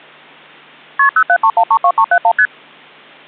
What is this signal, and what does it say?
Multi-frequency trunk signalling (R1, as on North American trunks), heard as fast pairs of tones, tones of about 70 ms. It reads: KP 073132371 ST